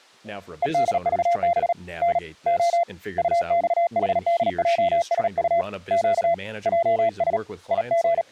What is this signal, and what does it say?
Morse code, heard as a keyed tone, hand-sent with a paddle, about 37 wpm, 680 Hz, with speech in English. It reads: EDVB N O UXHDJSU Q JS …